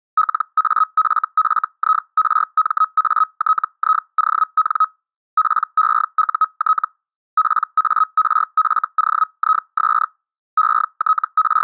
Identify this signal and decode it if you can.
Hellschreiber (Feld-Hell, 122.5 baud), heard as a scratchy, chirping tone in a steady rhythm, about 1270 Hz. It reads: LAFFIRMATION PEUT PARFOIS …